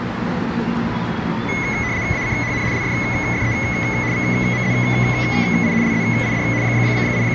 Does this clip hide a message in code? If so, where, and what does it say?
Yes: RTTY (75 baud, 170 Hz shift) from 1.5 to 7.3 s, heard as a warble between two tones, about 2100 Hz centre, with the noise of a residential street. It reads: ACHN LFFE VMZI LZID …